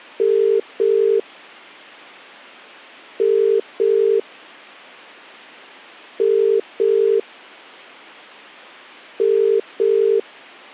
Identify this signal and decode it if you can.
Telephone call progress tone (as in the UK, Ireland, Australia and similar networks), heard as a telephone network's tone, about 400, 450 Hz. Ringback tone.